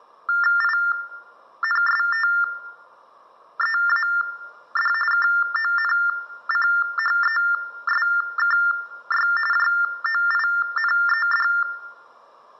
TTY/TDD text telephone tones (45.45 baud Baudot), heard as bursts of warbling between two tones, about 400 Hz shift, 1600 Hz centre, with room echo. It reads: INSTEAD KONCHESKY JOINED